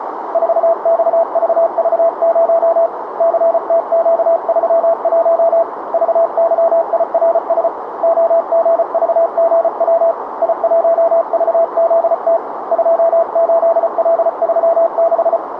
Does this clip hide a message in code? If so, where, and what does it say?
Yes: Morse code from 0.3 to 15.4 s, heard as a keyed tone, hand-sent with a paddle, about 34 wpm, 670 Hz, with radio static and a narrow filter. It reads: 4XVV0 CTQ31 VYIRS OGVGW I1VZT 28L36